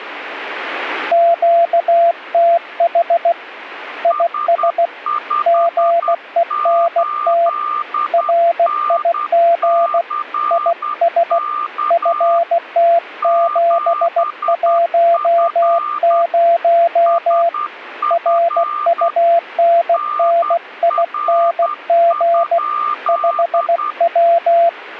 Morse code, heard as two keyed tones. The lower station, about 16 wpm, 680 Hz: QTH IS GENT RIG IS FT710 RUNNING 5W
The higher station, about 10 wpm, 1200 Hz: S58NCK 7F SF NR?